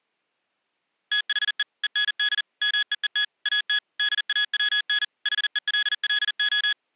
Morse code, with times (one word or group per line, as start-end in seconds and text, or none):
1.1-1.6 THE
1.8-2.4 END
2.6-3.2 MEET
3.5-3.8 AT
4.0-5.0 DAWN
5.3-6.7 HELLO